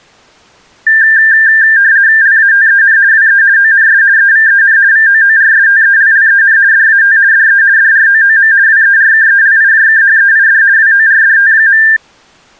RTTY (50 baud, 170 Hz shift), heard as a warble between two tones, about 1700 Hz centre. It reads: LATEN WE ONS EVEN VOORSTELLEN DAT DE DROOM WERKELIJKHEID WORDT.